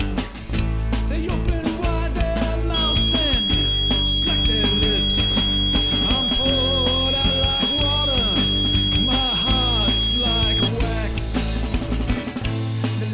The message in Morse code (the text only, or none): none